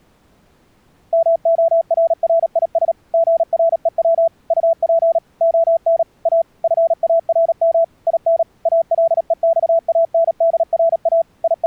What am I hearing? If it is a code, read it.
Morse code, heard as a keyed tone, machine-sent, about 37 wpm, 660 Hz. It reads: MORRIS GREW UP ON A FARM IN ALEXANDRA …